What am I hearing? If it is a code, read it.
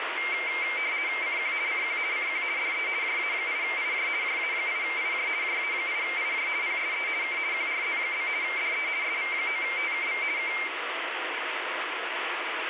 RTTY (50 baud, 170 Hz shift), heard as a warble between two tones, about 2200 Hz centre, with radio static. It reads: CQ CQ CQ DE JA8IJ JA8IJ JA8IJ PSE K QRZ? DE SV9TKV K